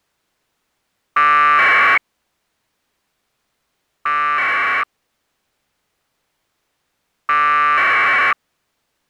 Packet radio (AX.25, as in APRS), 1200 baud, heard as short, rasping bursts.